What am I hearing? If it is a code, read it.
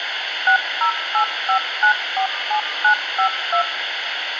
DTMF, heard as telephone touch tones, dialled by machine, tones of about 100 ms, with phone line noise. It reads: 6085947952